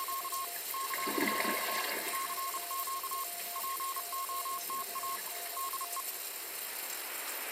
Morse code, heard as a keyed tone, hand-sent with a paddle, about 31 wpm, 1080 Hz, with radio static, a weaker station near 700 Hz and the noise of a restroom. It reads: … CQ CQ POTA DE